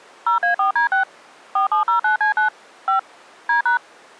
DTMF, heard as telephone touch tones, dialled by machine, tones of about 120 ms. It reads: 0A4D6 4709C9 5 D#